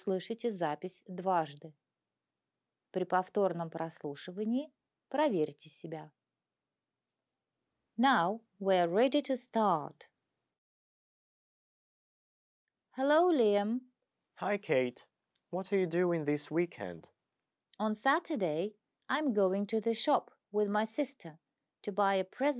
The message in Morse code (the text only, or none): none